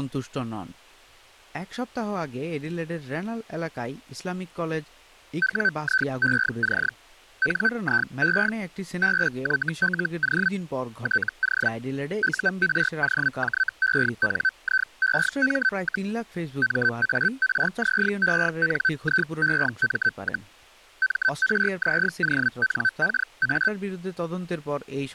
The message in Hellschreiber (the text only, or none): WIEC NIE BYLO TO UROJENIEM, MARZENIEM, MRZONKA